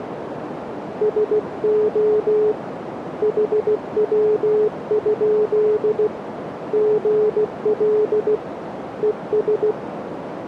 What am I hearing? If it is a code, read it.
Morse code, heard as a keyed tone, hand-sent with a paddle, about 16 wpm, 430 Hz, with radio static and a narrow filter. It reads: SO HW? GL ES